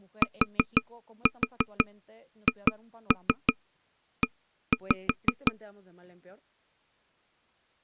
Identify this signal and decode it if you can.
Tap code, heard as taps on a table, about 5 knocks a second, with speech in Spanish. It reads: THE